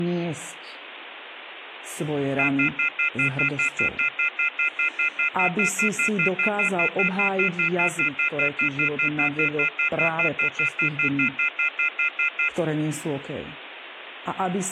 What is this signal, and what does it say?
Telephone call progress tone (North American plan), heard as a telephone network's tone, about 1400, 2050, 2450, 2600 Hz, 0.1 s on and 0.1 s off, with phone line noise and speech in Slovak. Off-hook warning tone.